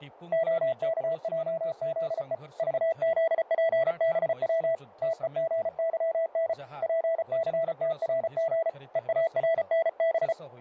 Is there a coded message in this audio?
Yes: Morse code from 0.3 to 10.4 s, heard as a keyed tone, hand-sent with a paddle, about 34 wpm, 660 Hz, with radio static, fading and speech in Odia. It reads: OKJZE VZPBW TEGYN PCTRG EARNB